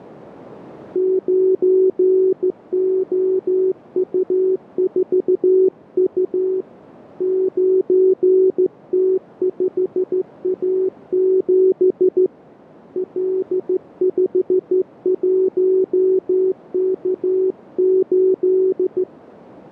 Morse code, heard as a keyed tone, hand-sent with a straight key, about 14 wpm, 380 Hz, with radio static. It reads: 9OU4U 9T5A7 L51K8